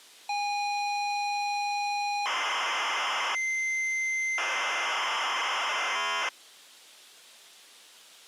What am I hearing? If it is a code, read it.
ZX Spectrum tape loading, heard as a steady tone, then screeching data.